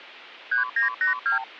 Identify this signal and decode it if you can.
Multi-frequency trunk signalling (R2, with the far end's replies), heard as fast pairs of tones, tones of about 120 ms. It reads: 3982